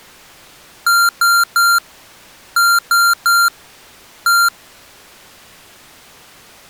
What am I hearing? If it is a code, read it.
Beep code, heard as beeps from a small speaker, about 1390 Hz. 3-3-1.